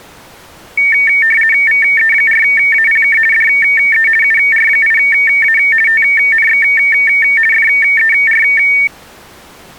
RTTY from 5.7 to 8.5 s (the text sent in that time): TNX FER